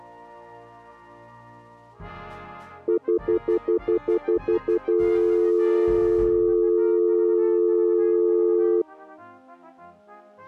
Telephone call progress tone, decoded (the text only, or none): stutter dial tone